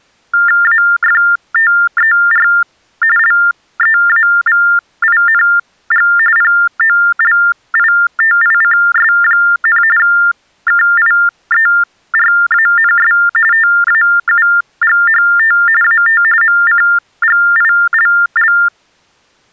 TTY/TDD text telephone tones (45.45 baud Baudot), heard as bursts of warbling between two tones, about 400 Hz shift, 1600 Hz centre. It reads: AFTER LEAVING POLITICS, KIERANS TAUGHT AT MCGILL